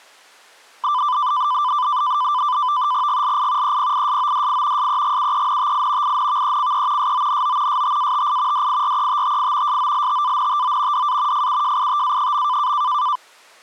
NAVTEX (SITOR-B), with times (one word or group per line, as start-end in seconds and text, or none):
3.1-3.8 GLI
3.6-4.9 EPISODI
4.8-6.2 SEGUENTI
6.0-7.1 INVECE
7.0-7.8 SONO
7.7-8.7 STATI
8.5-9.8 DIRETTI
9.7-11.1 SOLTANTO
10.9-11.5 DA
11.3-12.7 FUJITA.